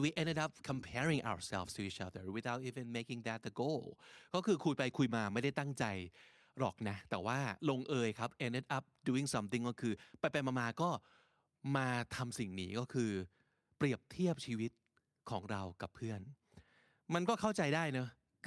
Speech in English. There is no code.